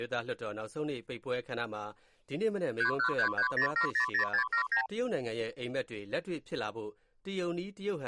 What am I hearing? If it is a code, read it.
Multi-frequency trunk signalling (R2, with the far end's replies), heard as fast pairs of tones, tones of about 100 ms. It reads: 31330700679